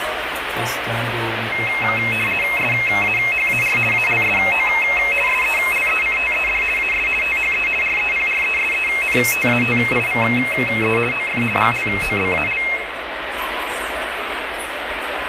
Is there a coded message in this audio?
Yes: RTTY (50 baud, 450 Hz shift) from 1.5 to 12.8 s, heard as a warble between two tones, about 2350 Hz centre, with radio static. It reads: SAHAR ALSO SELECTED AS THE REPRESENTATIVE OF GLOBAL